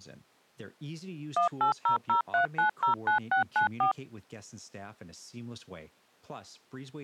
DTMF, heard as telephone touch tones, dialled by machine, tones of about 110 ms, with speech in English. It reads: 18003909694